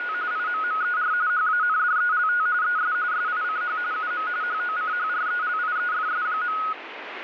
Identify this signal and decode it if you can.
RTTY (45.45 baud, 170 Hz shift), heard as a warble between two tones, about 1360 Hz centre, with radio static. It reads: … IMMER HANDELT ES SICH UM HOCHRELIEFS.